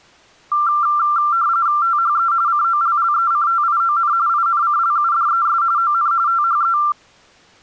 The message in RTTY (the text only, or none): THE COLLECTION INCLUDES ON THE